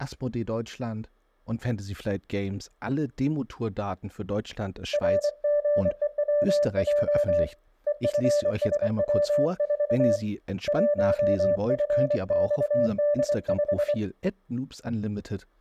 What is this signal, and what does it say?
Morse code, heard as a keyed tone, hand-sent with a paddle, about 24 wpm, 590 Hz, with speech in German. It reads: RGEWJ EFSW4 1FXD5